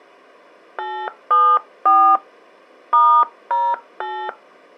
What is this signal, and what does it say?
DTMF, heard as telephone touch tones, dialled by hand, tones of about 270 ms. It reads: 874 *08